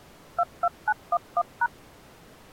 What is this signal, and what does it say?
DTMF, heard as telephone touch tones, dialled by machine, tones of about 50 ms. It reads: 22911#